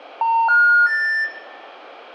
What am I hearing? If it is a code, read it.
Telephone call progress tone (North American plan), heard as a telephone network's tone, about 910, 1430, 1800 Hz, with room echo. Special information tone.